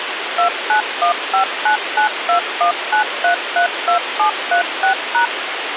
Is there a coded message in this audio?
Yes: DTMF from 0.4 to 5.3 s, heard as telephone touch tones, dialled by machine, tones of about 100 ms, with radio hiss. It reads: 291599219332736#